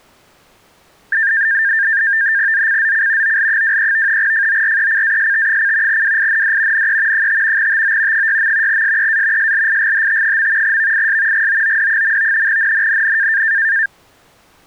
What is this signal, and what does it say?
NAVTEX (SITOR-B), 100 baud, 170 Hz shift, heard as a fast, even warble, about 1700 Hz centre. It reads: ZCZC OL23 FORECAST: WIND NE 5 TO 6. SEA SLIGHT. VIS GOOD. NNNN